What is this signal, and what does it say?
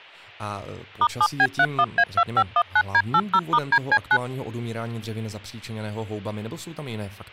DTMF, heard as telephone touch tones, dialled by machine, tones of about 60 ms, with speech in Czech. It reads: *7B31A2519D80*DC9